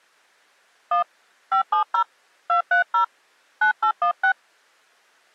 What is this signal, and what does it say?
DTMF, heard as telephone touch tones, dialled by hand, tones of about 110 ms. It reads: 1 570 230 9816